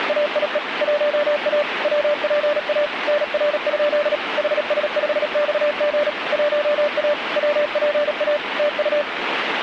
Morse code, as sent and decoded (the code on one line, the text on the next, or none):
… / .---- .- / .-- .--. .- / -. .-. ..--.. / .... ... ..... -..- --. / .---- .- / .-- .--. .- / - ..-
… 1A WPA NR? HS5XG 1A WPA TU